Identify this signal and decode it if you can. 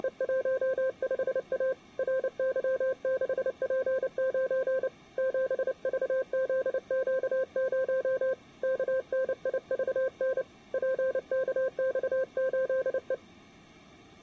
Morse code, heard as a keyed tone, hand-sent with a paddle, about 29 wpm, 520 Hz. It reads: … RY6P9 7VZQ0 KNIVN PKX8E